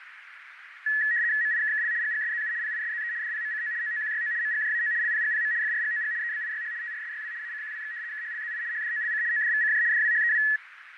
RTTY (75 baud, 170 Hz shift), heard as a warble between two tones, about 1800 Hz centre, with radio static, fading and a narrow filter. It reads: MIKKL GGSZU PISZE DPMCO OOQYO MGJAO LPGPM FRGOG EBIYH TRSYW ACQWX KHLZI HDOLC ODVCJ DWHEW